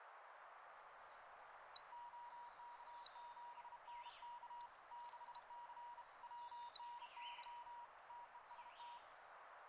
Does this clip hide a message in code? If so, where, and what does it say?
Yes: Morse code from 1.9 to 9.0 s, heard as a keyed tone, hand-sent with a bug key, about 32 wpm, 960 Hz, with radio static and a narrow filter. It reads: OK7NK 6C WNY TEST